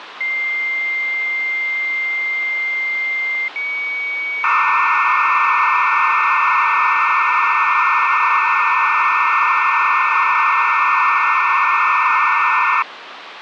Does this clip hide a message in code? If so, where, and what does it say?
Yes: dial-up modem handshake (low-speed, two carriers) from 0.2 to 12.8 s, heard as two whistles, then hiss, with phone line noise.